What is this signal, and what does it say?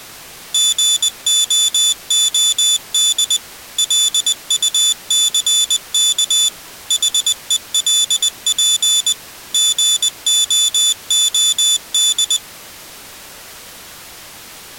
Morse code, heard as a high beeper, machine-sent, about 20 wpm, 3500 Hz. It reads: GOOD LUCK HELP GOOD